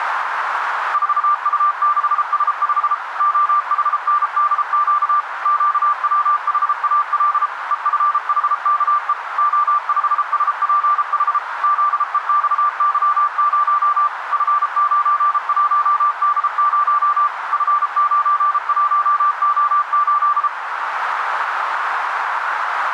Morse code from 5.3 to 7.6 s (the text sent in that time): QWHAL